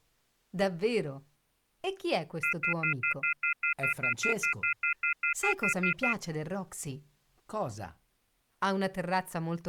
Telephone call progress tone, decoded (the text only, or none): off-hook warning tone